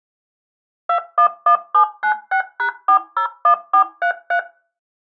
DTMF, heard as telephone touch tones, dialled by machine, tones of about 90 ms. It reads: 211796#401433